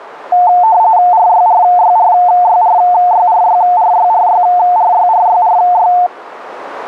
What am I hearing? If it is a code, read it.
RTTY (45.45 baud, 170 Hz shift), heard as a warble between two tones, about 800 Hz centre, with radio static. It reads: RYRYRYRYRYRYRYRYRYRY